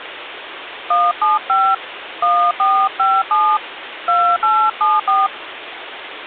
DTMF, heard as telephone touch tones, dialled by hand, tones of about 240 ms, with phone line noise. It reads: 175 1457 2874